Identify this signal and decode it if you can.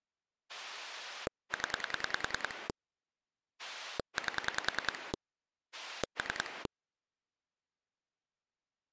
Pulse dialling, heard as a rotary dial, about 10 pulses a second. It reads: 0 8 3